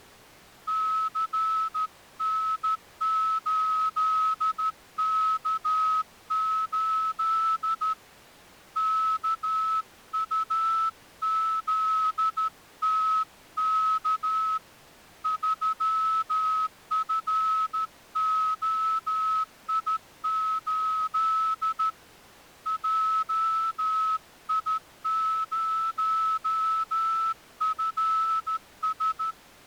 Morse code, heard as a whistle, hand-sent with a straight key, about 13 wpm. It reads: CN8K8 KUZTK 3FOI8 JI0FS